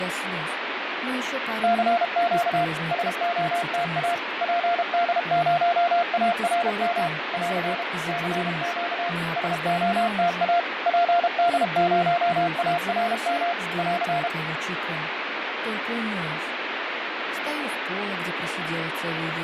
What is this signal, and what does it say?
Morse code, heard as a keyed tone, machine-sent, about 32 wpm, 690 Hz, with heavy radio static and fading. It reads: CQ SOTA PD0ARM <AR> CQ SOTA PD0ARM <AR>